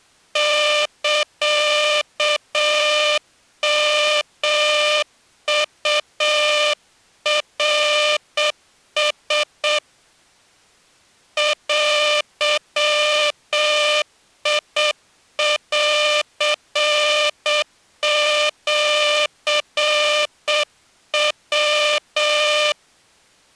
Morse code (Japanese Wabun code), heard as a buzzer, hand-sent with a straight key, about 7 wpm. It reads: サヨウナラ デンシヤ